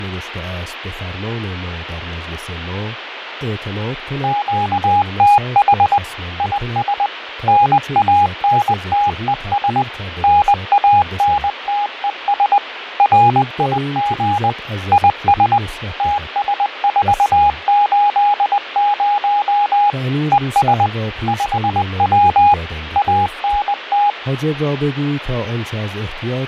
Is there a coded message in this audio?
Yes: Morse code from 4.2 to 24.2 s, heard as a keyed tone, machine-sent, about 20 wpm, 820 Hz, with radio static and fading. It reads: QTH IS NANTES NANTES RIG IS TS480 ES 5W ANT